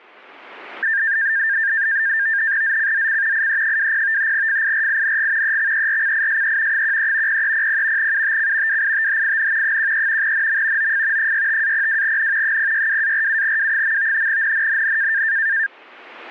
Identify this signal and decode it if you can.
NAVTEX (SITOR-B), 100 baud, 170 Hz shift, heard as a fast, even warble, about 1700 Hz centre. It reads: ZCZC IE20 FIRING EXERCISE 13 0300 UTC WITHIN 13 NM OF 65-02N 062-47W. NNNN